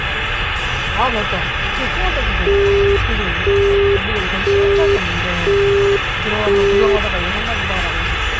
Telephone call progress tone (single-tone plan, as in Europe, Japan and elsewhere), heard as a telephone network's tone, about 400 Hz, 0.5 s on and 0.5 s off, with phone line noise and the noise inside a car. Busy tone.